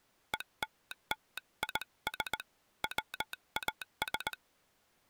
Morse code (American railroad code), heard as a telegraph sounder, hand-sent with a straight key. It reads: ELLIS WAS